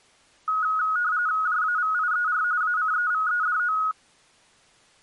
RTTY (45.45 baud, 170 Hz shift), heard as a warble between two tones, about 1360 Hz centre. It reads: JAVIER ACEVEDO